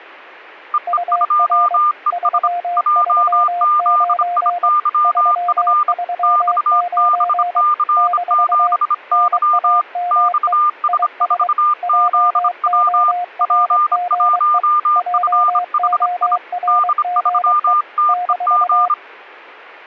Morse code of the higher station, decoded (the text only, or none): EE2ES JZIYF XBC7Y XS4ZW P1FHI D3TEG